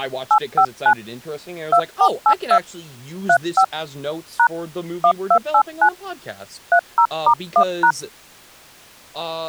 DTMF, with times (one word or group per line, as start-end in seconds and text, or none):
0.3-0.9 859
1.7-2.6 2482
3.3-3.6 35
4.4-4.5 #
5.0-5.9 1289
6.7-7.9 30*1#